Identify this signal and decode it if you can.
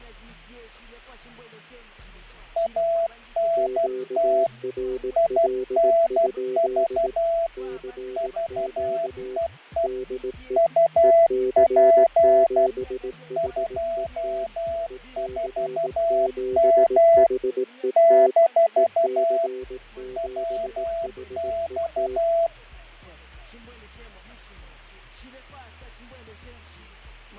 Morse code, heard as two keyed tones, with fading. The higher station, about 12 wpm, 670 Hz: ANT INV VEE UP 24M - WX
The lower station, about 18 wpm, 380 Hz: QRL? CQ DE EC7HET EC7HET EC7HET